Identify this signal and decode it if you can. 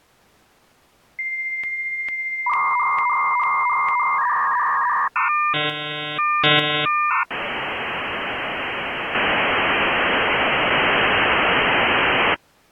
Dial-up modem handshake (V.34 or later), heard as a whistle, warbles, then hiss.